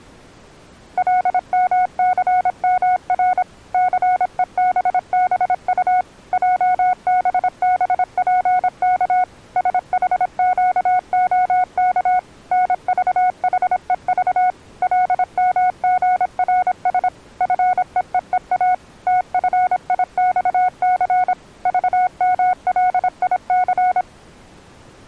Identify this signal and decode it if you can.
Morse code, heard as a keyed tone, machine-sent, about 26 wpm, 730 Hz. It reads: LMCMR CEBBU JBBPK SHQOK NVHEV LMGRS FEEEA TFIXC VMLIC